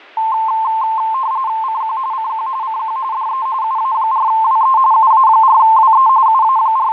RTTY (45.45 baud, 170 Hz shift), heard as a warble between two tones, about 970 Hz centre, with fading. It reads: CQ CQ CQ DE UA4WE UA4WE …